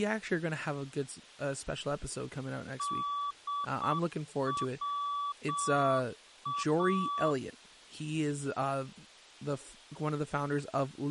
Morse code (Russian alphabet), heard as a keyed tone, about 7 wpm, 1150 Hz, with speech in English. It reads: ДВА